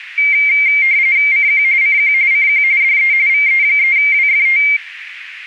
RTTY (45.45 baud, 170 Hz shift), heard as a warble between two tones, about 2200 Hz centre, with radio static. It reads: CQ CQ CQ DE VE3WFT